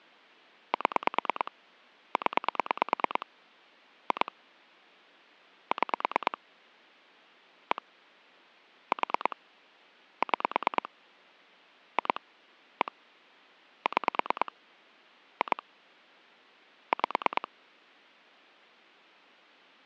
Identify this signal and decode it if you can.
Pulse dialling, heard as clicks on a phone line, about 9 pulses a second. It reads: 7 0 2 6 1 4 6 2 1 6 2 5